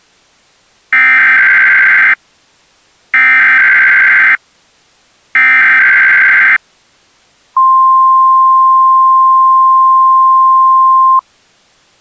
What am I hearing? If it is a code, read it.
Emergency Alert System (SAME) tones (header bursts, then the 1050 Hz attention tone), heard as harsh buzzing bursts, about 520.83 baud.